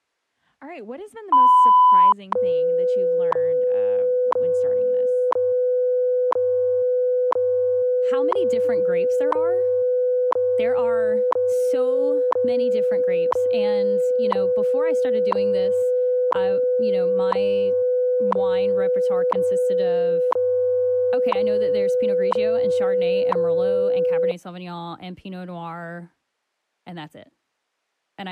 Radio time signal (WWV, Colorado), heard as ticks, one a second, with speech in English.